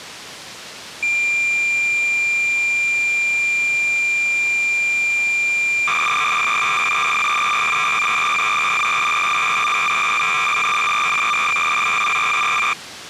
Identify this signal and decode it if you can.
Cassette data (Kansas City type), 300 baud, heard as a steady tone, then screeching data.